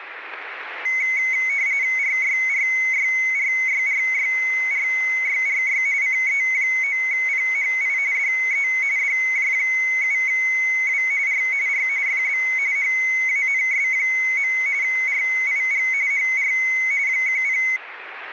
RTTY (45.45 baud, 170 Hz shift), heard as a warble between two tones, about 2150 Hz centre, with radio static. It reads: RYRYRYRYRYRY CE9PHI DE DJ7W R R FB HANS. RIG HR 10